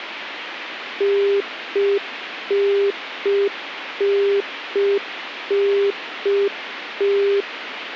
Telephone call progress tone (UK plan), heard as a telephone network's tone, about 400 Hz, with phone line noise. Congestion tone.